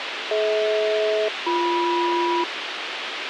Aircraft SELCAL, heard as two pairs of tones, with radio hiss. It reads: DH-BM